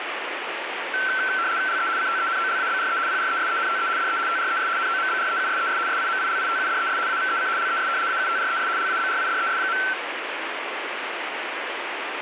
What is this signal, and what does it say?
RTTY (75 baud, 170 Hz shift), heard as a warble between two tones, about 1440 Hz centre, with radio static. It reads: LE CTENOLABRE PRESENTE DE TRES NOMBREUSES SIMILITUDES AVEC LES AUTRES LABRIDES.